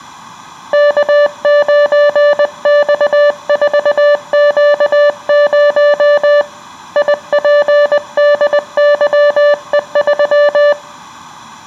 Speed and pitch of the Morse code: 20 wpm, 580 Hz

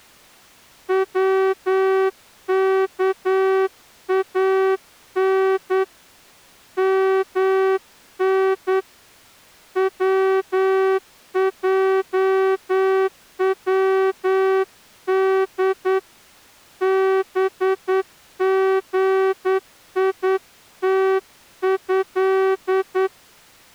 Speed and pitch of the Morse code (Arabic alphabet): 9 wpm

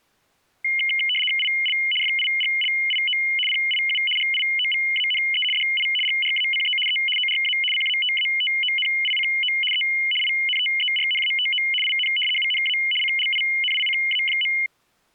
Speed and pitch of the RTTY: 75 baud, 850 Hz shift, 2550 Hz centre

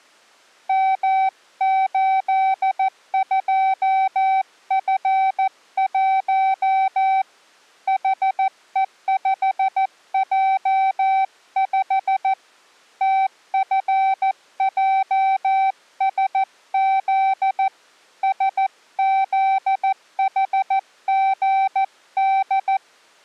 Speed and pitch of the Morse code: 14 wpm, 770 Hz

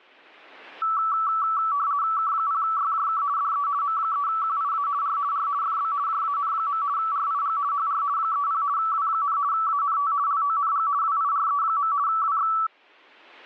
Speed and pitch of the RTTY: 50 baud, 170 Hz shift, 1230 Hz centre

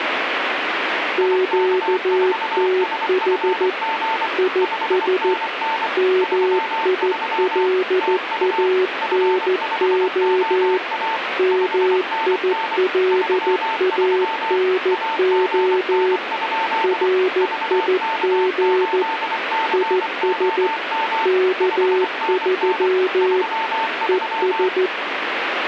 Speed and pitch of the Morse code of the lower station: 14 wpm, 370 Hz

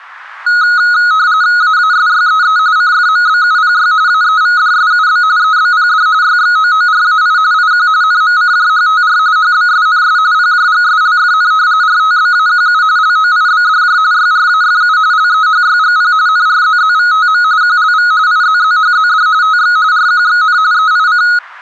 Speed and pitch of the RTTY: 45.45 baud, 170 Hz shift, 1360 Hz centre

